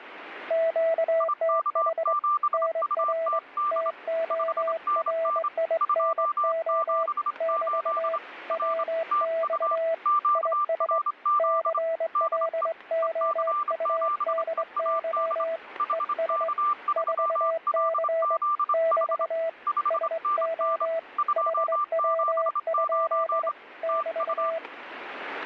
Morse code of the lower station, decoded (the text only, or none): QTH NR TORINO <BT> WX IS CLOUDY ES 4C <BT> SO HW? <BT>